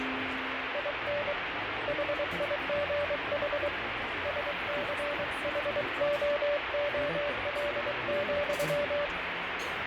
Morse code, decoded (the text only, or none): IN HIGH SCHOOL,